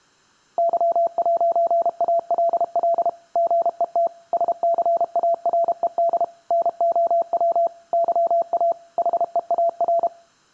Morse code, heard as a keyed tone, machine-sent, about 32 wpm, 680 Hz. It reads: Y'ALL GET SCARED NOW YA HEAR